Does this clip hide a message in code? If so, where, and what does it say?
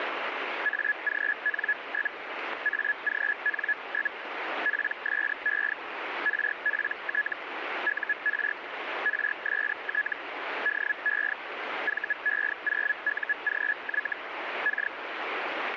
Yes: Hellschreiber (Feld-Hell, 122.5 baud) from 0.6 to 14.9 s, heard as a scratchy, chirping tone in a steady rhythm, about 1700 Hz, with radio static. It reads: AGN? AGN? PSE RPT UR RST DE VE0UGY K